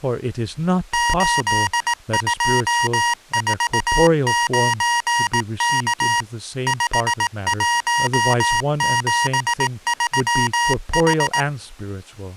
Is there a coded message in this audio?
Yes: Morse code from 0.9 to 11.5 s, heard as electronic beeps, machine-sent, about 18 wpm, 950 Hz, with speech in English. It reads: 8249K 5173H